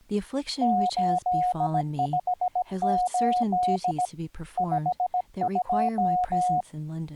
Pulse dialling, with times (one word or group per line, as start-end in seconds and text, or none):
none